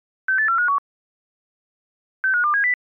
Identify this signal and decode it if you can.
Five-tone selective call (CCIR), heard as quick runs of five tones, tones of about 100 ms. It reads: 68451 65270